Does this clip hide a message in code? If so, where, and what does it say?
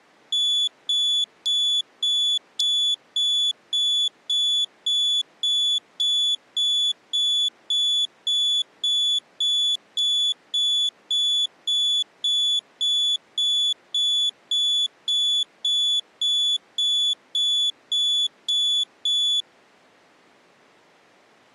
No, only evenly repeated beeps.